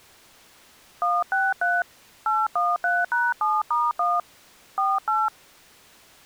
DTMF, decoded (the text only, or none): 163 813#7*1 48